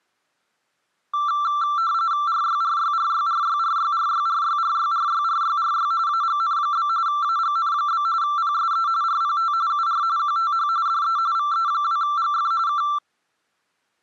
RTTY (45.45 baud, 170 Hz shift), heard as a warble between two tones, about 1260 Hz centre. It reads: RYRYRYRYRYRYRYRYRYRYRY AGN? AGN? PSE RPT UR QTH DE VE2GF K